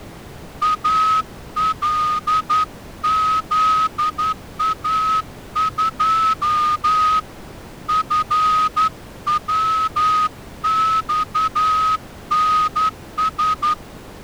Morse code, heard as a whistle, hand-sent with a straight key, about 11 wpm. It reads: ALZA2 FWXNS